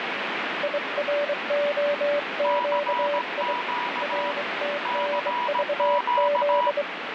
Morse code, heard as two keyed tones, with heavy radio static. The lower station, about 23 wpm, 580 Hz: IROQI RTNVZ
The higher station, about 17 wpm, 970 Hz: CQ CQ